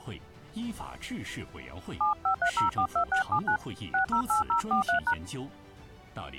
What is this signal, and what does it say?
DTMF, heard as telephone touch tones, dialled by hand, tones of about 100 ms. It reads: 753042679 608043#